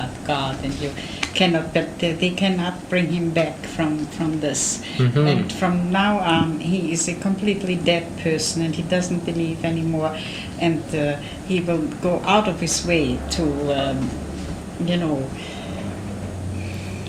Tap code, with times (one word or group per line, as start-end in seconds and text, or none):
none